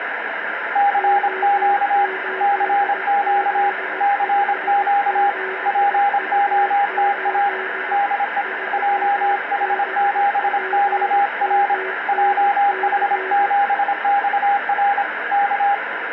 Morse code, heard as two keyed tones, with radio static. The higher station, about 26 wpm, 810 Hz: CQ CQ CQ POTA DE JH7XR JH7XR K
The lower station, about 17 wpm, 380 Hz: O8Z57U8 3BPMNC